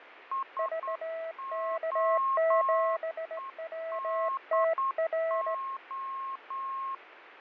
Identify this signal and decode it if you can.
Morse code, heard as two keyed tones, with radio static and fading. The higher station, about 9 wpm, 1080 Hz: SOEDO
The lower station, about 17 wpm, 650 Hz: VK7WTR